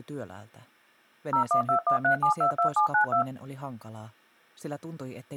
DTMF, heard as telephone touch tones, dialled by machine, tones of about 100 ms. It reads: 01213722792